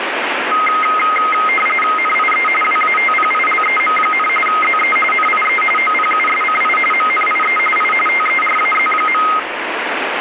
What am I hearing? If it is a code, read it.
RTTY (45.45 baud, 850 Hz shift), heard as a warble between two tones, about 1700 Hz centre, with radio static. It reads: NIE WATPILEM, ZE NIE OPUSCI MNIE I TERAZ.